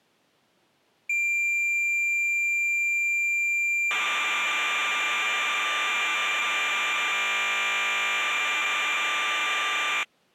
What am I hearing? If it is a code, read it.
Cassette data (Kansas City type), 1200 baud, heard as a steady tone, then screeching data.